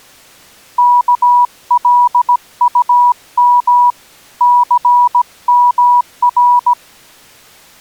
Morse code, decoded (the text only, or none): KLUM CMR